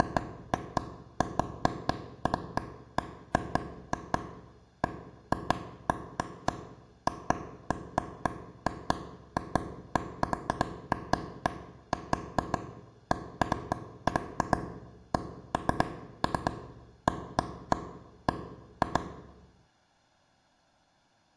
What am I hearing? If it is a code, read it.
Irregular taps on a table, with room echo. There is no code.